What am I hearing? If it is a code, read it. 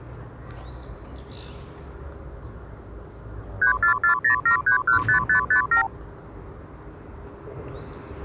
Multi-frequency trunk signalling (R2, with the far end's replies), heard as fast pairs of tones, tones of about 100 ms, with the noise of a park. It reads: 34407315557